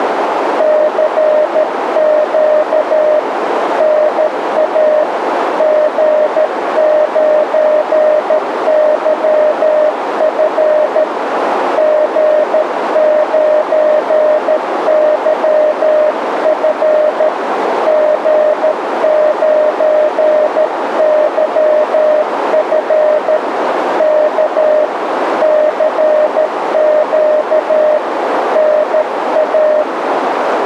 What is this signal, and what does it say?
Morse code, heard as a keyed tone, hand-sent with a paddle, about 13 wpm, 610 Hz, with radio static and a narrow filter. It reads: CQ NA G9YF G9YF G9YF K CQ NA